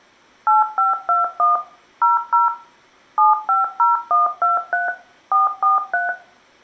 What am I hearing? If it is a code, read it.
DTMF, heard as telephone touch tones, dialled by machine, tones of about 160 ms, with room echo. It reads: 8521 00 750123 443